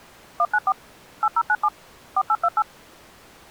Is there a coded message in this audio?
Yes: DTMF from 0.4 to 2.6 s, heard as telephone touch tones, dialled by machine, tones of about 50 ms. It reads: 194 8097 4828